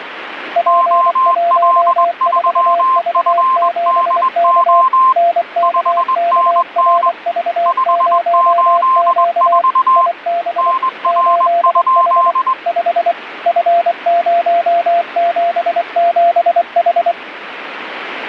Morse code, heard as two keyed tones, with radio static. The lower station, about 24 wpm, 690 Hz: P14V7K NKKRV0Q IB 8H 5 F077H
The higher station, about 21 wpm, 1050 Hz: OL3FDO 5NN 584 NR?